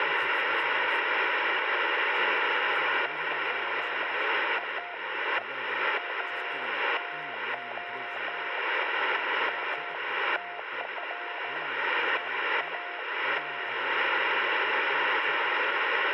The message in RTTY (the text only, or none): none